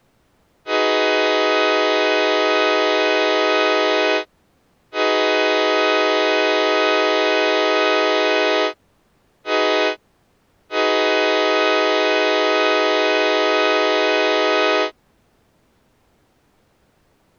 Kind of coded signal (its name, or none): train horn signal